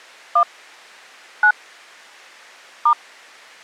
DTMF, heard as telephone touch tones, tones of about 80 ms. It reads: 1 9 *